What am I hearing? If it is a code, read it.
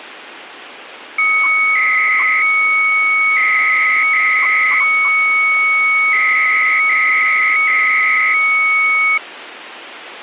300-baud modem data (Bell 103 tones), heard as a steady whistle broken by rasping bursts, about 300 baud, 200 Hz shift, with phone line noise.